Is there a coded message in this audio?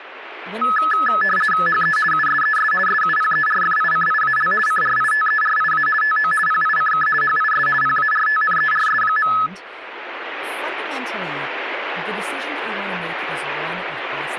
Yes: RTTY (50 baud, 450 Hz shift) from 0.6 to 9.5 s, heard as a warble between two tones, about 1500 Hz centre, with speech in English. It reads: HE USES SUPERFICIAL CRITERIA TO PICK HIS PARTNERS.